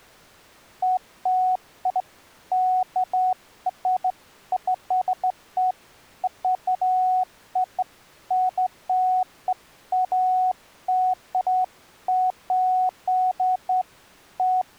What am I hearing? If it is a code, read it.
Beeps of irregular length. There is no code.